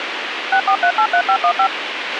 DTMF, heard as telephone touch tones, dialled by machine, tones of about 80 ms, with radio hiss and a squelch burst at the end. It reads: 64383515